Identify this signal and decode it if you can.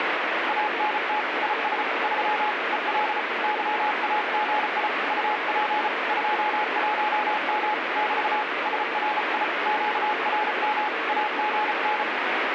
Morse code, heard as a keyed tone, hand-sent with a paddle, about 34 wpm, 850 Hz, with heavy radio static. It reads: ANT IS 3 EL YAGI UP 21M <BT> SRI QRM AGN